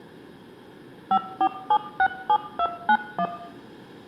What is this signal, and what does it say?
DTMF, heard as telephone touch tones, dialled by machine, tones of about 70 ms, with room echo. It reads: 54767291